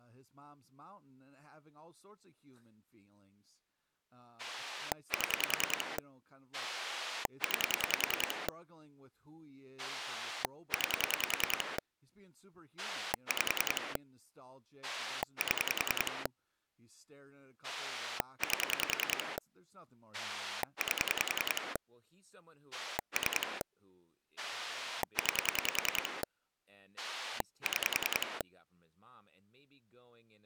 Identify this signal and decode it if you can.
Pulse dialling, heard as a rotary dial, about 10 pulses a second, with speech in English. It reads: 7 9 9 5 7 8 8 3 9 6